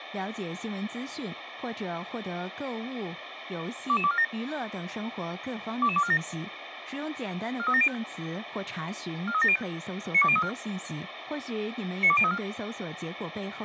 Five-tone selective call (ZVEI), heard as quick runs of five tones, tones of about 70 ms, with radio hiss. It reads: 22247 22247 43705 43705 92034 92034